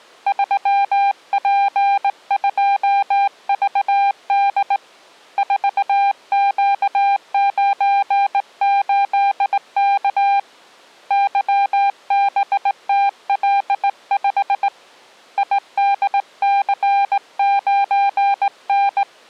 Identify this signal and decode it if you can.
Morse code, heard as a keyed tone, hand-sent with a straight key, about 18 wpm, 800 Hz. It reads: 3P2VD 4Q98K YBTL5 IDC9N